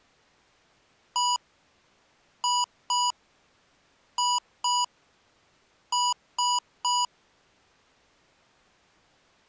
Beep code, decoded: 1-2-2-3

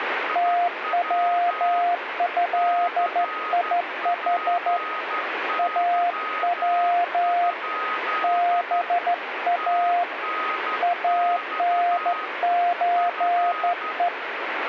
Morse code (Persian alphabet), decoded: توضیح او با انچه

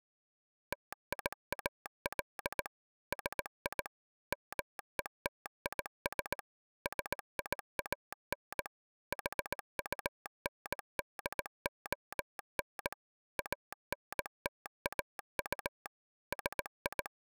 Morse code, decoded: TIAL SI METIS SIAN HUNDON ANTAU …

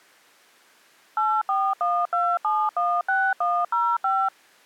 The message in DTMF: 8412716105

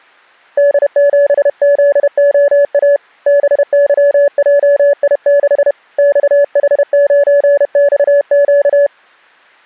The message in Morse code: D7ZOA BYJI6 XH9XQ

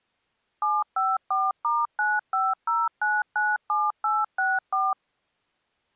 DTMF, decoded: 754*950997864

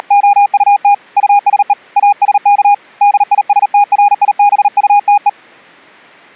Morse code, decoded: … USE ASK DISTRIBUTE

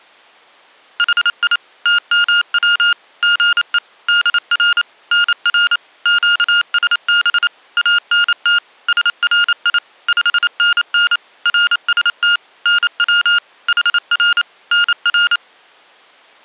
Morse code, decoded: HI TMW GE DR NR QSB ANT SRI 5NN RST NW HR NR

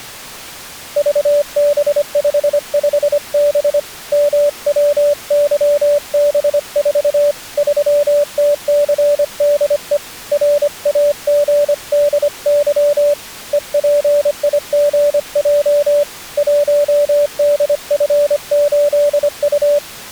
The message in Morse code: VB55B MWYB4 3TCDE RAGDY EPIGJ 1DF8U

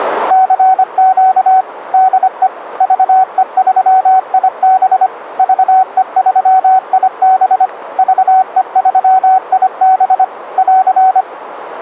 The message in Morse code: CQ DE VE3IB VE3IB VE3IB <AR>

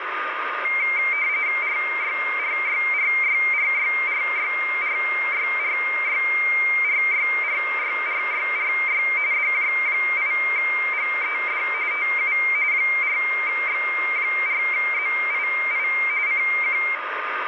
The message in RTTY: RYRYRYRYRYRYRYRYRYRYRY DJ8GED TU 4X4ZII CQ

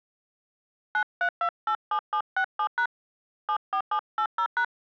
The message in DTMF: 93287767# 74780#

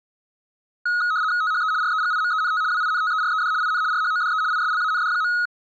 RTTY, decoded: THE REGIMENT WINTERED IN RHODE ISLAND.

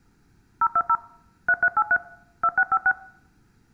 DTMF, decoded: 020 3383 2656

